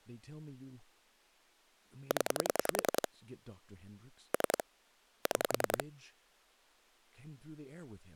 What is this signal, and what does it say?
Pulse dialling, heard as clicks on a phone line, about 10 pulses a second, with speech in English. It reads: 0 3 6